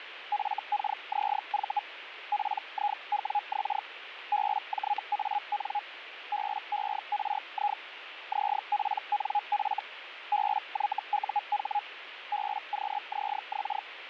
Hellschreiber (Feld-Hell, 122.5 baud), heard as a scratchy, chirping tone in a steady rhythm, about 830 Hz, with radio static. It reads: FKZV PIWX BJAN BERI ZPNF BYUH BQZX